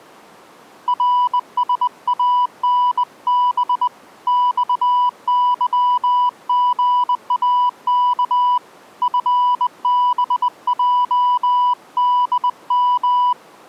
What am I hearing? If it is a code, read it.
Morse code, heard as a keyed tone, hand-sent with a bug key, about 20 wpm, 990 Hz. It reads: RSANB XYGAK FBJDM